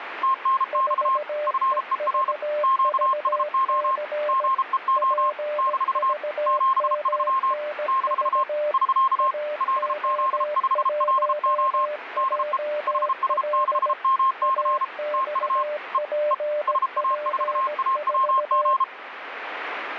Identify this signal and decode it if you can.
Morse code, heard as two keyed tones, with radio static. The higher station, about 33 wpm, 1060 Hz: TNX FER QSO GEO - 73 - <SK> LZ5LO DE HS6MC TU E E SA4AWG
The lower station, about 17 wpm, 600 Hz: 4EVVC PVMNV AO1JL AXPP4